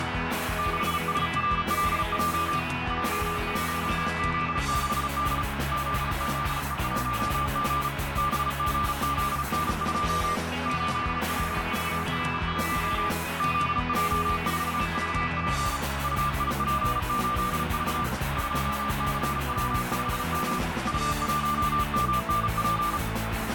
Morse code, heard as a keyed tone, hand-sent with a paddle, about 35 wpm, 1190 Hz, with heavy radio static and a narrow filter. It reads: 6SRLJ J1Z6D ZZE1G BGZN2 8LVR1 ZJ4VP UIP8V 2CW5M U1MNP